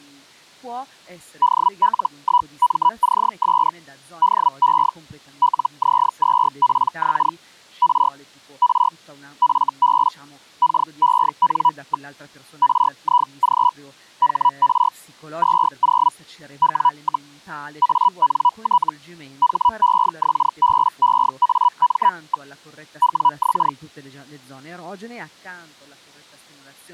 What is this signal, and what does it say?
Hellschreiber (Feld-Hell, 122.5 baud), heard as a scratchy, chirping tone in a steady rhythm, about 980 Hz, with speech in Italian. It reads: DL1MCS DE LZ2PX R R FB KEN. RIG HR 20 W, ANT HEXBEAM. WX